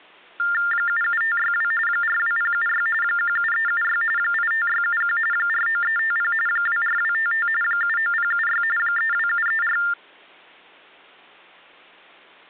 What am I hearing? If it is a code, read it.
TTY/TDD text telephone tones (45.45 baud Baudot), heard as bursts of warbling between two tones, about 400 Hz shift, 1600 Hz centre. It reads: 77562 42076 17376 85671 49350 24255 79076 32734